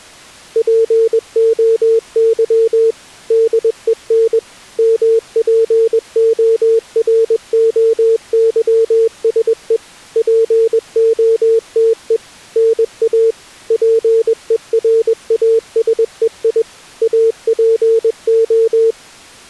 Morse code (Greek alphabet), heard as a keyed tone, machine-sent, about 21 wpm, 450 Hz. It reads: ΠΟΥ ΔΕΝ ΜΠΟΡΟΥΣΕ ΠΟΤΕ ΝΑ ΠΕΡΑΣΕΙ ΑΠΟ